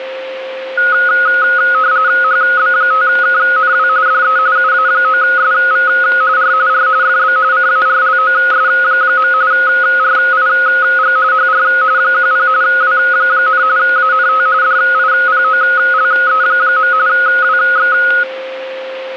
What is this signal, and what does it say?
RTTY (45.45 baud, 170 Hz shift), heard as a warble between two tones, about 1360 Hz centre, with a steady whistle near 530 Hz. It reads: HB5KNW DE UA9SV R R FB CARLOS. RIG HR 10 W, ANT DIPOLE. WX